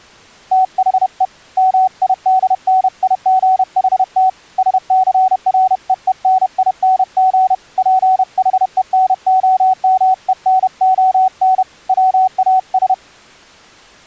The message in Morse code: THE MIDNIGHT SCREENING PHENOMENON WAS

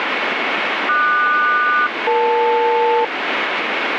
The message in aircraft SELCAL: QS-EL

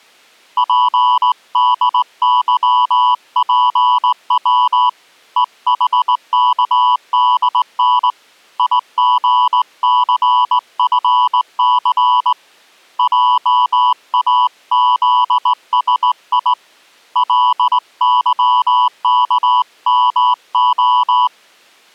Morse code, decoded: PDYPW EHKDN IGCFC JAZSI LYKMO

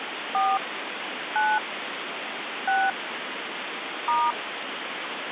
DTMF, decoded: 4 9 6 *

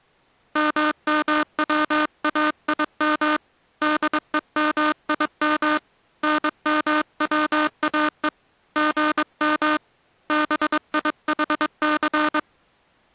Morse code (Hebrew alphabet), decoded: ממצאים דומים נמצאו גם ביחס

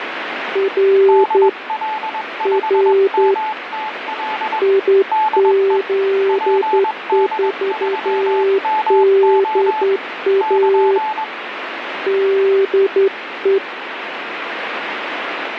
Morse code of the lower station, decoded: R R IZ4DA DE

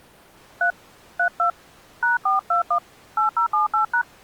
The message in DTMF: 3 32 #421 8078#

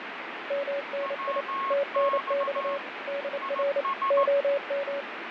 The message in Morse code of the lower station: MNI TNX DR OM

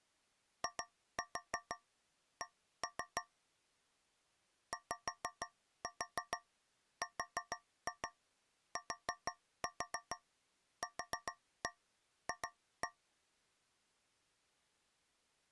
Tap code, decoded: IC YRTQF

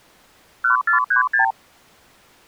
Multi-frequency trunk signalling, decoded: 1436

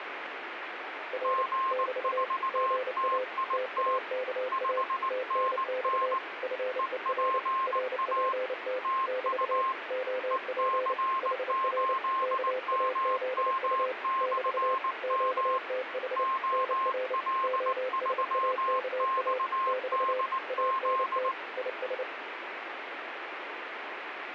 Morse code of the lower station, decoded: R <BT> GA TAKA TNX FER RPT <BT> OP HR KAZU <BT> QTH NR OSAKA <BT> ANT IS

